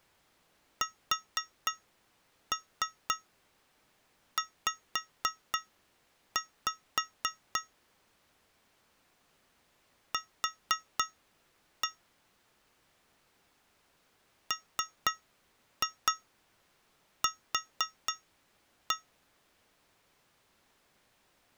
Tap code, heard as taps on glass, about 4 knocks a second. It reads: SZ Q MQ